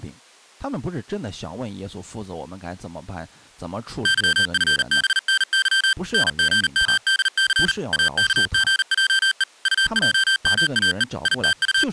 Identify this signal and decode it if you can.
Morse code, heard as electronic beeps, machine-sent, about 39 wpm, 1550 Hz, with speech in Chinese. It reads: YFBNY NGMDC AKGJE UJMAE …